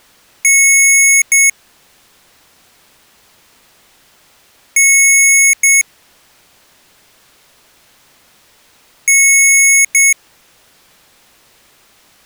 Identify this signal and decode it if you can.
Beep code, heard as beeps from a small speaker, played three times, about 2200 Hz. 1 long, 1 short. In IBM BIOS tables: system board problem.